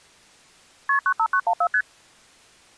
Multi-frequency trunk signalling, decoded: KP 95914 ST

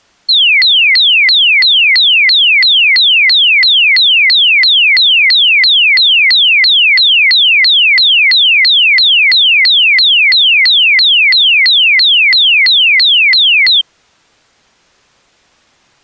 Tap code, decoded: none

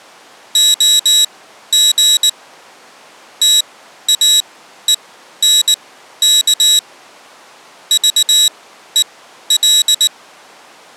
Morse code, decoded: OG TAENK VEL

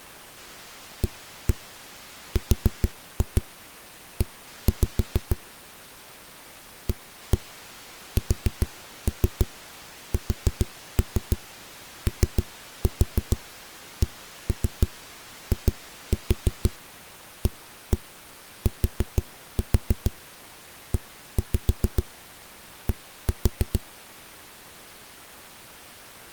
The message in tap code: ARE ASSOCIATED

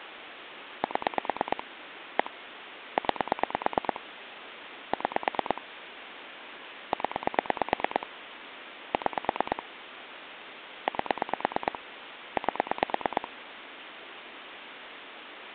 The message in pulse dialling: 7 1 9 6 0 6 8 8

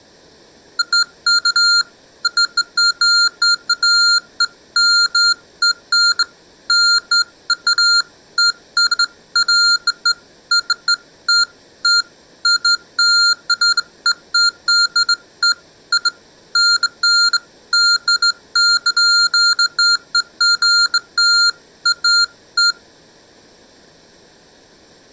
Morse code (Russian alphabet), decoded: none

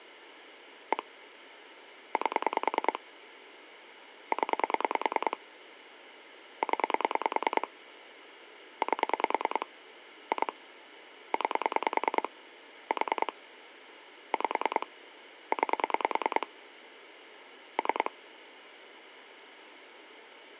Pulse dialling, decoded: 1 8 0 0 8 2 9 4 5 9 3

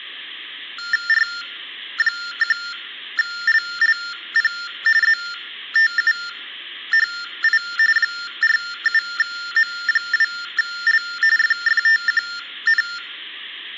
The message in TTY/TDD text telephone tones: R1LLP ZTUHI 47M2L FFTQN

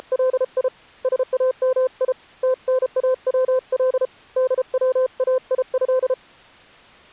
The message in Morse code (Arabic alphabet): … سامي تناول دوايه

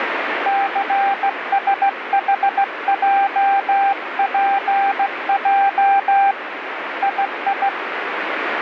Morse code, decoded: CSHJPJ II

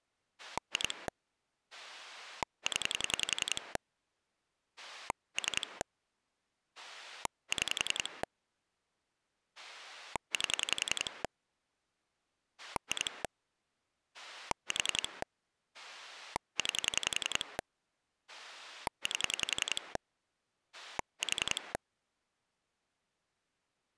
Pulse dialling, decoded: 2 0 3 6 8 2 4 9 8 4

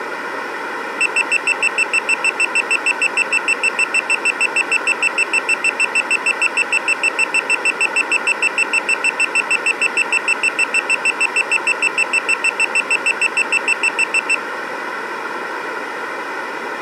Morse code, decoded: none

